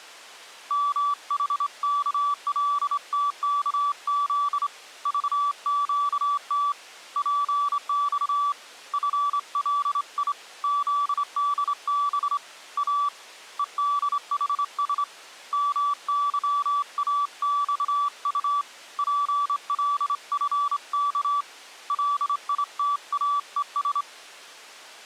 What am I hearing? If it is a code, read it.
Morse code, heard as a keyed tone, hand-sent with a straight key, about 26 wpm, 1150 Hz. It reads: MHKLTKZ VQT PX FLI ZDB A EDHS MYAXU PLFK LITAES